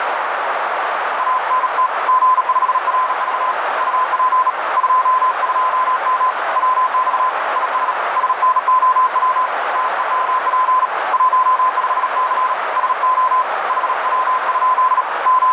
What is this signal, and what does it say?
Morse code, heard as a keyed tone, hand-sent with a bug key, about 37 wpm, 1020 Hz, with heavy radio static and a narrow filter. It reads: ANT G5RV UP 22M WX IS SNOW TEMP 15C SO HW? …